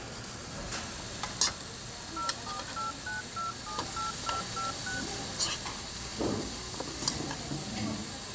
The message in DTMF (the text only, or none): 0489278256